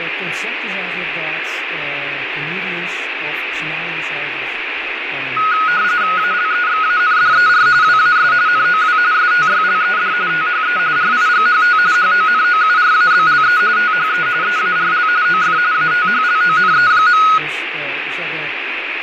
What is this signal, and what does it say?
RTTY (45.45 baud, 170 Hz shift), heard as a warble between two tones, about 1360 Hz centre, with radio static and fading. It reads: ALEXANDER WAS NOW STYLED THE RIGHT HONOURABLE THE EARL OF ATHLONE.